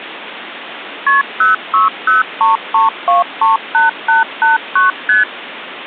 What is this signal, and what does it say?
Multi-frequency trunk signalling (R1, as on North American trunks), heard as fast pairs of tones, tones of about 150 ms, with phone line noise. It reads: KP 06033238889 ST